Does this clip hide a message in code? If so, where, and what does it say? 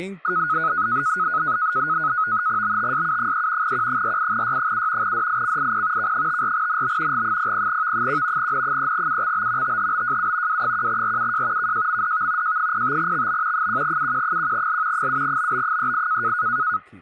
Yes: NAVTEX (SITOR-B), 100 baud, 170 Hz shift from 0.2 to 16.8 s, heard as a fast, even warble, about 1360 Hz centre, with speech in Manipuri. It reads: BTSU3 Q48Y7 DICIP K54NB G00V1 N3UXB THBJU W1RUJ KJMDV J05XB 1UQ1L 7BB38